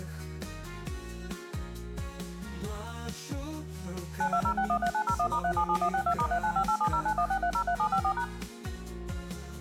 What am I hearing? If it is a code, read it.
DTMF, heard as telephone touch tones, dialled by machine, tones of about 80 ms. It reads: 920613901*377162*395870916303754#